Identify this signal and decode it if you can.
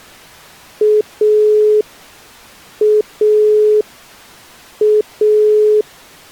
Telephone call progress tone (pulsed, as in Italy), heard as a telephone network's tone, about 420 Hz. Dial tone.